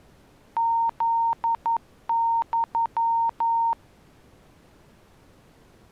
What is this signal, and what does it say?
Morse code (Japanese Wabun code), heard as a keyed tone, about 11 wpm, 920 Hz. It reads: フユ